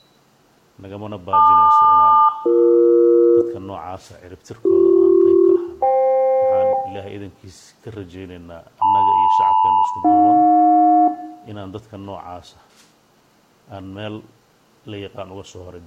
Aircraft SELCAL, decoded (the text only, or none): LQ-BE BC-FK LM-AJ